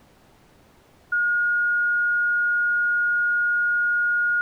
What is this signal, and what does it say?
A steady tone. There is no code.